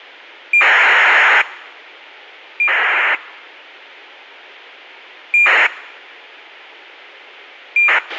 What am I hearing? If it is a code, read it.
ACARS aircraft data, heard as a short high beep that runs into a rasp, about 2400 baud, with a squelch burst at the end.